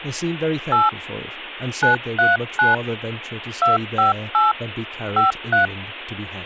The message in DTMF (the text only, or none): 8 939 258 53